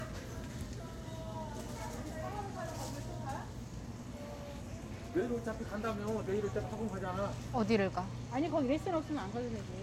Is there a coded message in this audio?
No, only the noise of a crowd indoors.